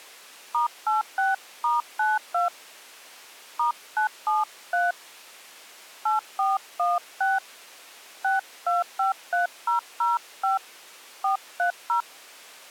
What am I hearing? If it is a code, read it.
DTMF, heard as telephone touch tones, dialled by hand, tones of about 150 ms. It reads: *86*92 *973 8416 6253005 430